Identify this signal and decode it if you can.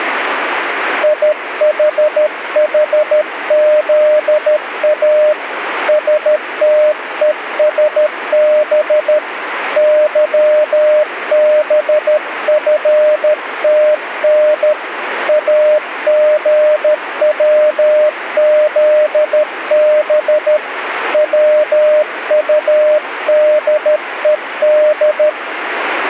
Morse code, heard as a keyed tone, hand-sent with a paddle, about 13 wpm, 610 Hz, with radio static. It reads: IHHZA STESB YBFTN AGWZB WUDED